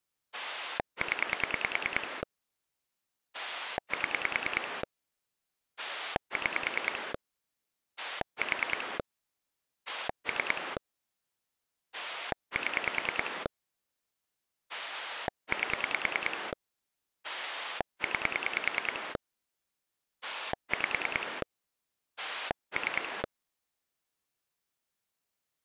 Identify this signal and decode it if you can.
Pulse dialling, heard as a rotary dial, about 10 pulses a second. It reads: 0 7 6 4 3 7 8 9 5 3